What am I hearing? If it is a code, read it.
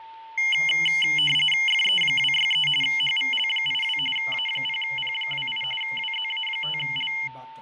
RTTY (45.45 baud, 850 Hz shift), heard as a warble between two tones, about 2550 Hz centre, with fading and a steady whistle near 900 Hz. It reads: FE263 HVL82 A0P28 WZA5L